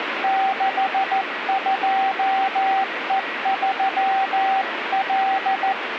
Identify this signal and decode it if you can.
Morse code, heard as a keyed tone, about 14 wpm, 770 Hz, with radio static and a weaker station near 1920 Hz. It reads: 62E3L